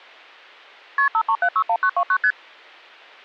Multi-frequency trunk signalling (R1, as on North American trunks), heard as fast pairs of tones, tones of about 70 ms. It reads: KP 53761929 ST